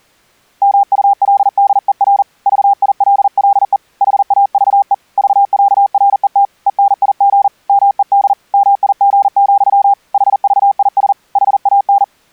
Morse code (with Danish letters), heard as a keyed tone, hand-sent with a paddle, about 40 wpm, 800 Hz. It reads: MULDER VILLE HAVE VÆRET ENIG MED MIG, HVIS HAN